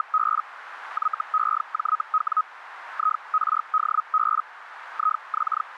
Hellschreiber (Feld-Hell, 122.5 baud), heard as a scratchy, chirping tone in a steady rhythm, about 1260 Hz, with radio static and a narrow filter. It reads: … YEJW IRDB …